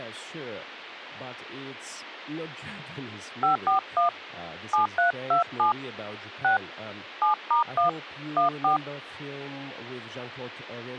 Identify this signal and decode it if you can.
DTMF, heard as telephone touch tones, dialled by hand, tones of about 120 ms. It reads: 541 7327 6 7*1 14